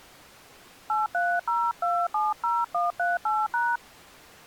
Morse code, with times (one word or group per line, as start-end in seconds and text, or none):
none